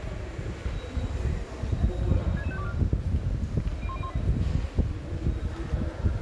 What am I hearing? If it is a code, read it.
Five-tone selective call (ZVEI), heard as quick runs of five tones, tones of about 70 ms, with room echo and the noise of a subway station. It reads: 66524 01018